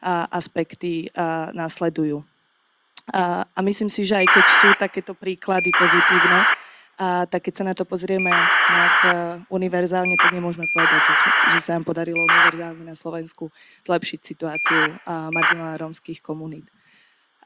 ACARS aircraft data, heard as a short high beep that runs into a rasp, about 2400 baud, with speech in Slovak.